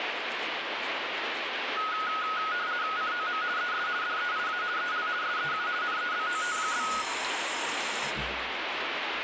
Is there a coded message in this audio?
Yes: RTTY (50 baud, 170 Hz shift) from 1.8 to 7.0 s, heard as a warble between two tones, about 1360 Hz centre, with radio static and the noise of a restroom. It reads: COM ES DEIA EL SEU NEBOT?